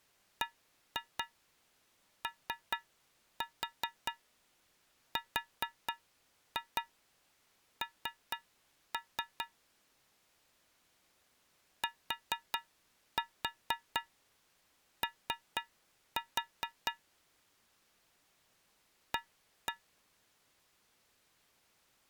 Tap code, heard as taps on a metal pipe, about 4 knocks a second. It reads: BORN TO A